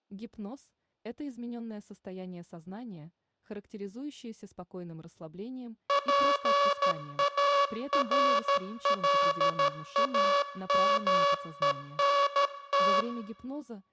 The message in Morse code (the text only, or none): PARLAMENT